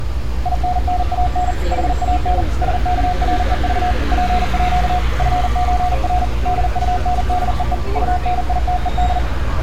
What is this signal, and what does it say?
Morse code (with Swedish letters), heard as a keyed tone, machine-sent, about 40 wpm, 720 Hz, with street noise. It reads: INNAN HAN SKREV PÅ FÖR DUNDEE UNITED